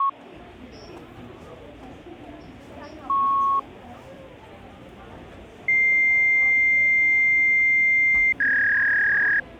Fax machine handshake, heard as a beep, a long tone and a warble, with the noise of a crowd indoors.